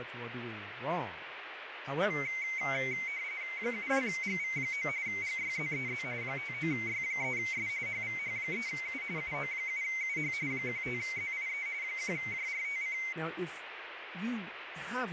RTTY (45.45 baud, 170 Hz shift), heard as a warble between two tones, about 2150 Hz centre, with radio static and speech in English. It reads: 72GV9 GYZEZ 59Y3S HVH3U UO7UH 15ZIE 1JRTC